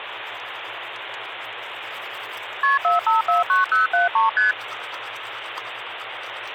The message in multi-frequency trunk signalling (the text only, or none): KP 4549073 ST